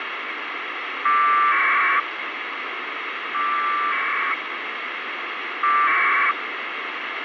Packet radio (AX.25, as in APRS), 1200 baud, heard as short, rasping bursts, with radio hiss and a squelch burst at the end.